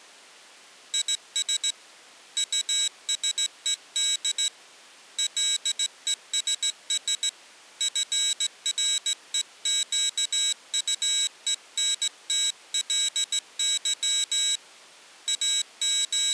Morse code, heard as a high beeper, hand-sent with a straight key, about 16 wpm, 3850 Hz. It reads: IS USED LESS FREQUENTLY …